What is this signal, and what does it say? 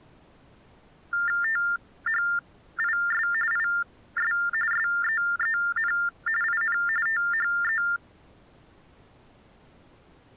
TTY/TDD text telephone tones (45.45 baud Baudot), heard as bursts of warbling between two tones, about 400 Hz shift, 1600 Hz centre. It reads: THIS IS SEEN IN THE